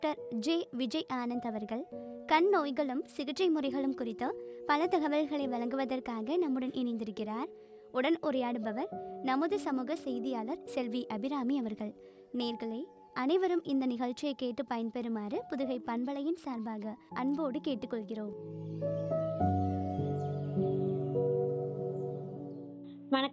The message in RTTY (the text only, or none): none